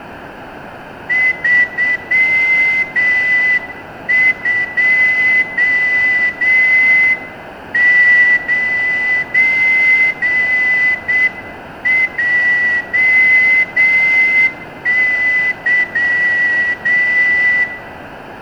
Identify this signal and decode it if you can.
Morse code, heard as a whistle, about 7 wpm, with room echo. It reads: 329JY